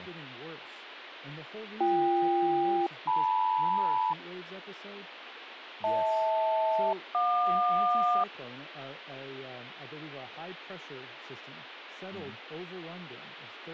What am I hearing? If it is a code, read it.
Aircraft SELCAL, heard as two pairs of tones, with radio static and speech in English. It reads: BK-LM HL-JQ